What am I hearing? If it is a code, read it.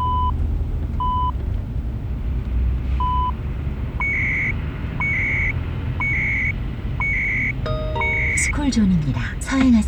Radio time signal (CHU, Canada), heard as beeps and data bursts, one a second, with the noise inside a car.